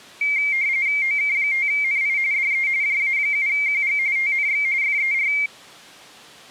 RTTY (45.45 baud, 170 Hz shift), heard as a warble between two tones, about 2200 Hz centre. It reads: OK5NI DE JA7QG TNX FER